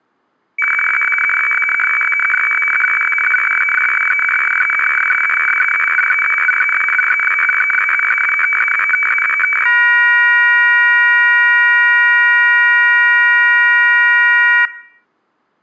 Weather fax (radiofax), 120 lines a minute, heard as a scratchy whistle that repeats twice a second.